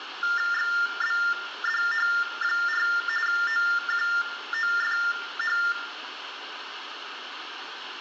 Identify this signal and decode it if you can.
TTY/TDD text telephone tones (45.45 baud Baudot), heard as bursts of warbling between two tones, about 400 Hz shift, 1600 Hz centre, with phone line noise and room echo. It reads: XBDH4 OQOFH